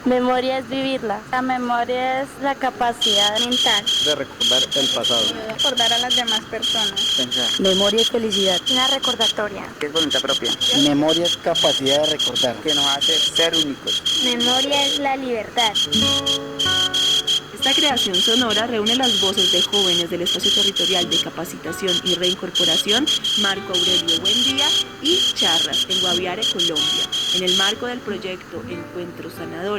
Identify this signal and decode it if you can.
Morse code, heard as a whistle, hand-sent with a straight key, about 14 wpm. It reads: YOL9Z 4I6ZJ FGCJP SXYQ2